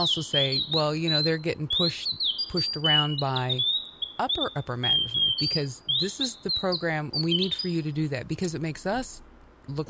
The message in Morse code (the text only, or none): none